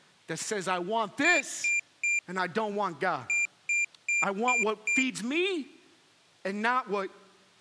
Beep code, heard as a piezo beeper, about 2400 Hz, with speech in English. 3-5.